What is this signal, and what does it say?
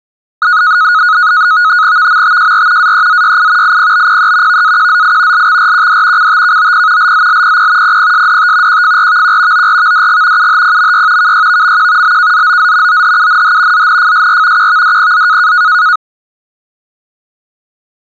NAVTEX (SITOR-B), 100 baud, 170 Hz shift, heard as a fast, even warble, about 1360 Hz centre. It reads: VMTJR AEZYI IPBPE VAQZI LXRQD CTKOP LZLPP PPSDT QFRVQ ORVDG UHPMY KYVMQ BKZOZ OHUNH ZNFSR QVDPZ